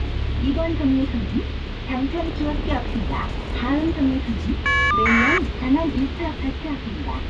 Caller ID data burst, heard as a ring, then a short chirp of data, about 1200 baud, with phone line noise and the noise inside a bus.